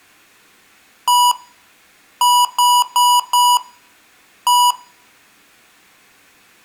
Beep code, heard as beeps from a small speaker, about 980 Hz, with room echo. 1-4-1. In Phoenix BIOS tables: address line failure in the first 64 KB of memory.